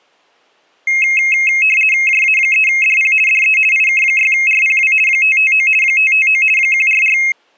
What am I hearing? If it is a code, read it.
RTTY (50 baud, 450 Hz shift), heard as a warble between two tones, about 2350 Hz centre. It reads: JA3DP DE IK6RPW 559 559 144